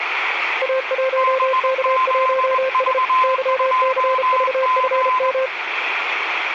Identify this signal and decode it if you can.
Morse code, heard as two keyed tones, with radio static. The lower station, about 33 wpm, 520 Hz: A1K1S YCVFM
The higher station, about 21 wpm, 1030 Hz: BZV2G